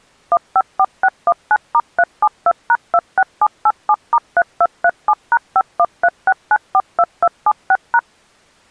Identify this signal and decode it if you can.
DTMF, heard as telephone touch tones, dialled by machine, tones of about 50 ms. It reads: 154619*372#26787*3237#5136942276#